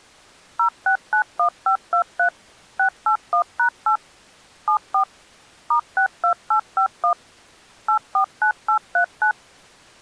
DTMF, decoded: 0691523 681#8 74 *62851 849839

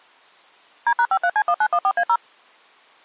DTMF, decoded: D#53C1914A0

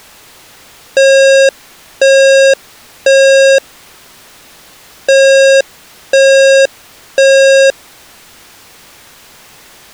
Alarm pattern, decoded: temporal three

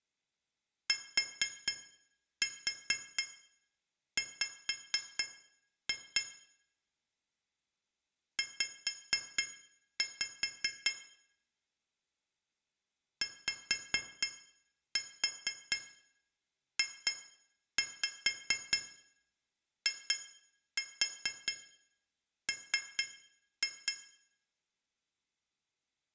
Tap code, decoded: TW Z YJIM

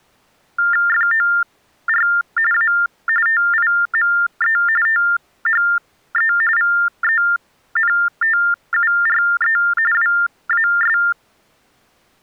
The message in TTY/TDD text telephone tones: FOR A TIME THE VENTURE WAS

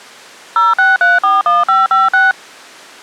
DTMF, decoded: 06341556

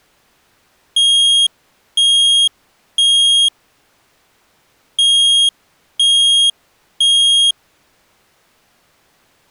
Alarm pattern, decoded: temporal three

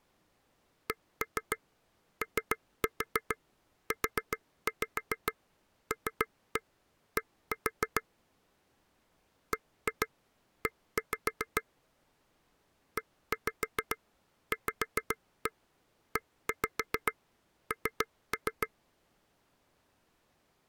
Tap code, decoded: COULD BE EVEN

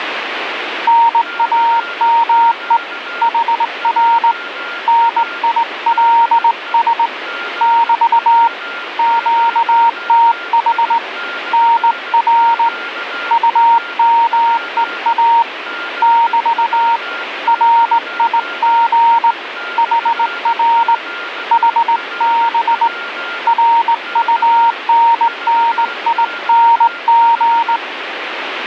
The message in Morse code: NAME HR NILS <BT> QTH NR UMEA <BT> RIG HR HB RUNNING

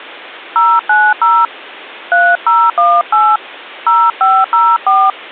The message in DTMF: 090 3018 0504

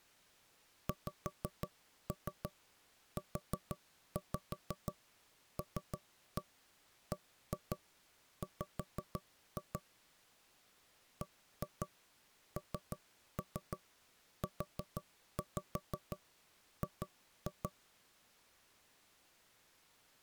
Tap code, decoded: XULBW BNUG

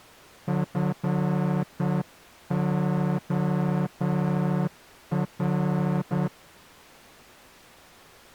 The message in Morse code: FOR

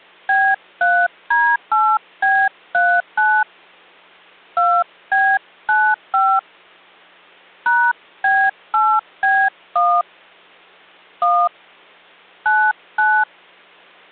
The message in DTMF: B3D8B39 2B95 #B8B1 1 99

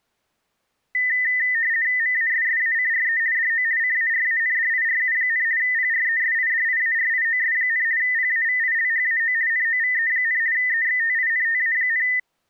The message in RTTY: MASSACRE DO CARANDIRU, PRESIDIARIOS, PAVILHAO NOVE, EXTINTA,

